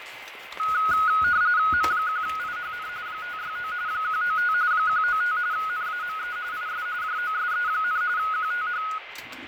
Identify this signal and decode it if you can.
RTTY (45.45 baud, 170 Hz shift), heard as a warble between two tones, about 1360 Hz centre, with radio static, fading, a steady whistle near 2070 Hz and kitchen noise. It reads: M1IHN 569 195 195 NAME IS JOSE, QTH